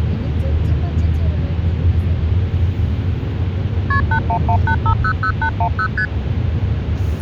Multi-frequency trunk signalling (R1, as on North American trunks), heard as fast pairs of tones, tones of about 80 ms, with the noise inside a car. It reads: KP 8118500810 ST